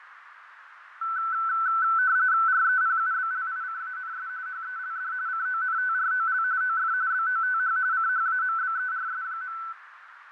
RTTY (45.45 baud, 170 Hz shift), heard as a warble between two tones, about 1420 Hz centre, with radio static, fading and a narrow filter. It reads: REPUBLICANS HELD CONTROL OF BOTH CHAMBERS.